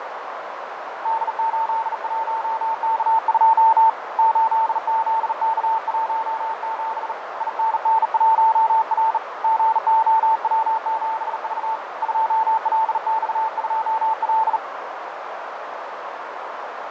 Morse code, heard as a keyed tone, hand-sent with a bug key, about 38 wpm, 890 Hz, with radio static, fading and a narrow filter. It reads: D81K2 8ZK17 INN1R GOW7V 2LX2L